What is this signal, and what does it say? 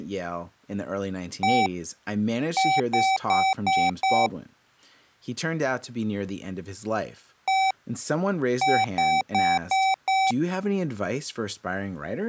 Beep code, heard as beeps from a small speaker, played twice, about 770 Hz, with speech in English. 1-5.